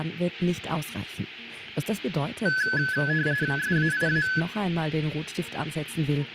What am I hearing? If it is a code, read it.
RTTY (45.45 baud, 170 Hz shift), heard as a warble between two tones, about 1600 Hz centre, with radio static. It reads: SAIA